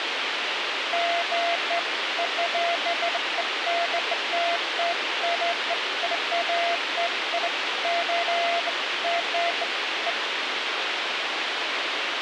Beeps of irregular length, with radio hiss. There is no code.